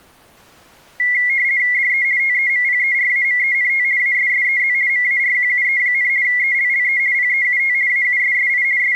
RTTY (50 baud, 170 Hz shift), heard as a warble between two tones, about 2050 Hz centre. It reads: DE TEMPERAMENT ASSEZ MARQUE, ELLE PEUT AUSSI …